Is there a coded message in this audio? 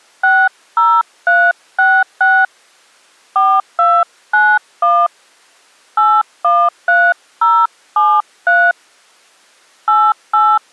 Yes: DTMF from 0.2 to 10.6 s, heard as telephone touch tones, dialled by hand, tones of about 240 ms. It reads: 60366 4291 813073 88